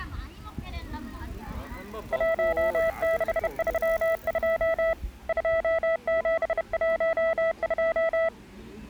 Morse code, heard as a keyed tone, hand-sent with a bug key, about 31 wpm, 660 Hz, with the noise of a park. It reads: 1632 2712